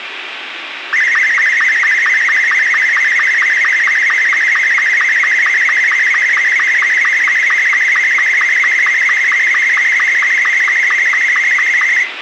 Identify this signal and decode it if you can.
SSTV (slow-scan television), Martin M2, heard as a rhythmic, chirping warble, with radio hiss.